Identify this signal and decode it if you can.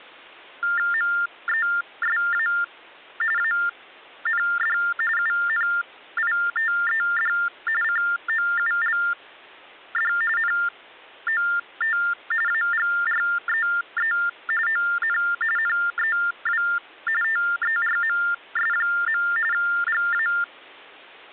TTY/TDD text telephone tones (45.45 baud Baudot), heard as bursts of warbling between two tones, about 400 Hz shift, 1600 Hz centre. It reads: MESA AND UNITED COULD NOT AGREE ON NEW TERMS. GA